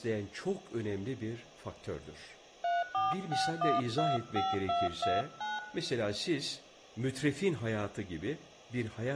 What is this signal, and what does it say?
DTMF, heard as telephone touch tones, dialled by hand, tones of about 190 ms, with room echo and speech in Turkish. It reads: 346125229